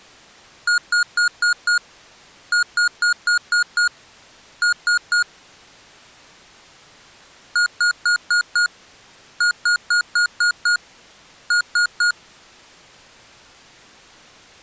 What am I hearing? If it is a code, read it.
Beep code, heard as beeps from a small speaker, played twice, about 1430 Hz. 5-6-3.